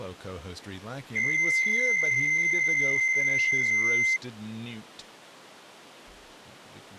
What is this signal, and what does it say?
PSK63 (62.5 baud), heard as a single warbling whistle, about 2100 Hz, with speech in English.